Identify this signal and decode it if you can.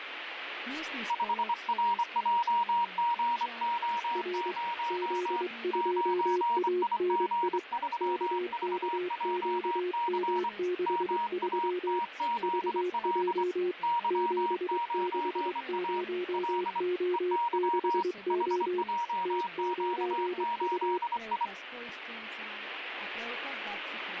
Morse code, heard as two keyed tones, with radio static. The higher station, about 24 wpm, 950 Hz: 5RJGO0 9IG3VJC MATZL Y9A L EY HJQ8I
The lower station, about 23 wpm, 360 Hz: R Z2ANI KKQM63 VJ 760O6O T9U